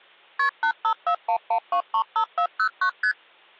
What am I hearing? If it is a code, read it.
Multi-frequency trunk signalling (R1, as on North American trunks), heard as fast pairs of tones, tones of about 80 ms. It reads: KP 85411235409 ST